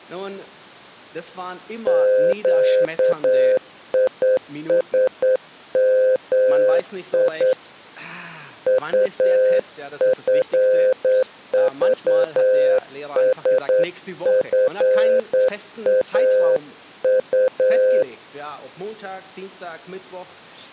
Morse code, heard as a keyed tone, hand-sent with a straight key, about 9 wpm, 520 Hz. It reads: QISMI UFVSFAU